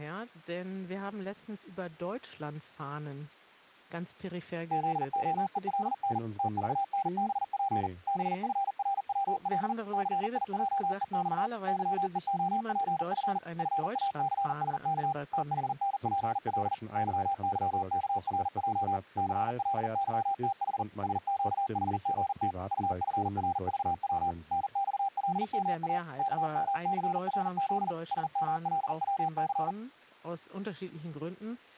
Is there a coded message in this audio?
Yes: Morse code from 4.7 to 29.8 s, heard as a keyed tone, machine-sent, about 40 wpm, 790 Hz, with speech in German. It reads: ZOELN TVNBP BFRWL CIJEX YEOPF FACSK THNPL YYKRJ CLYTH SQHGT UFRVW NXLMA KMCRZ SMLWC